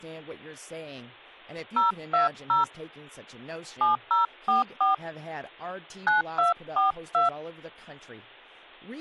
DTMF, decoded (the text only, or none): 020 7044 9242